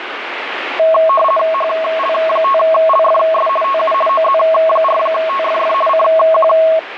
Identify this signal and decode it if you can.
RTTY (50 baud, 450 Hz shift), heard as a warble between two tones, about 870 Hz centre, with radio static. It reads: HL5LFS TU OZ4TFF CQ